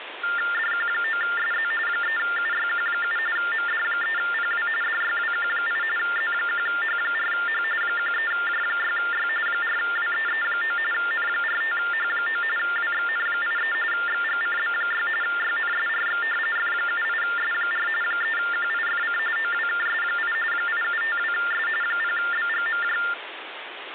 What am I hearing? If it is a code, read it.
TTY/TDD text telephone tones (45.45 baud Baudot), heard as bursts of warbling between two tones, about 400 Hz shift, 1600 Hz centre, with phone line noise. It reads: DQ9SZ 3UYQ7 MD3PW DYWQ8 Z1H4H 13J6Y 4WEE9 N45H9 WXN83 XGCB6 YNSRX F78S4 3QIFC OWKS8 8752S 0BGMJ